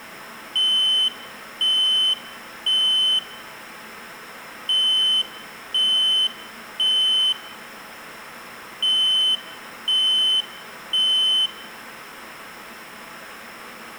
Alarm pattern, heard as an alarm's beeps, played three times, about 3050 Hz, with room echo. Temporal three. Smoke or fire, evacuate.